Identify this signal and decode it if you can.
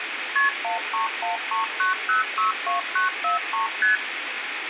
Multi-frequency trunk signalling (R1, as on North American trunks), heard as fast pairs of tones, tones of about 140 ms, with phone line noise and room echo. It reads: KP 13139062943 ST